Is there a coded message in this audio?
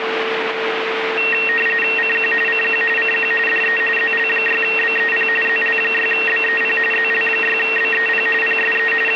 Yes: RTTY (45.45 baud, 850 Hz shift) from 1.2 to 9.2 s, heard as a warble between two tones, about 2300 Hz centre, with radio static and a steady whistle near 450 Hz. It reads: CQ CQ CQ DE ZL6BEP ZL6BEP ZL6BEP PSE …